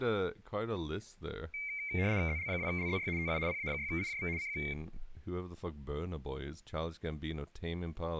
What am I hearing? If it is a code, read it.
RTTY (75 baud, 170 Hz shift), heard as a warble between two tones, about 2200 Hz centre, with speech in English. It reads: ZL2LZY TU PA6IJV CQ